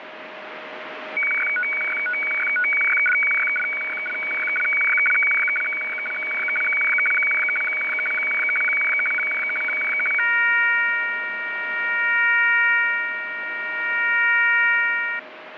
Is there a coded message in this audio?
Yes: weather fax (radiofax), 120 lines a minute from 1.2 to 15.2 s, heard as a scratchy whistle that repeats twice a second, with radio static.